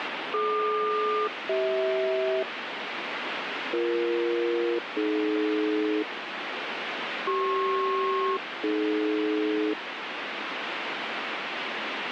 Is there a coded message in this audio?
Yes: aircraft SELCAL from 0.3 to 9.7 s, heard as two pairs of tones, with radio static. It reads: DQ-CH BE-AD CP-AD